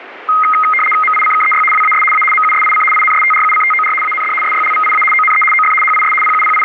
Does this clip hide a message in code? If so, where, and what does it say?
Yes: RTTY (75 baud, 850 Hz shift) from 0.3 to 6.6 s, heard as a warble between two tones, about 1700 Hz centre, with radio static. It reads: MICKEY WAS A MUSIC INSTRUCTOR AND SYLVIA ONE OF HIS …